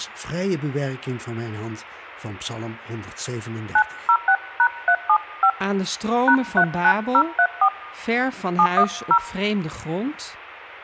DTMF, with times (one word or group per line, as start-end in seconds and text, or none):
3.8-5.5 906#375
6.3-7.7 #39034
8.6-9.2 710